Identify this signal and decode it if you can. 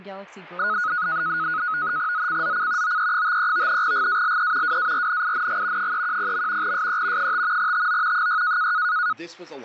NAVTEX (SITOR-B), 100 baud, 170 Hz shift, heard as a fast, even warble, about 1360 Hz centre, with speech in English. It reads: ZCZC OE53 GALE WARNING 310. SE 5 TO 6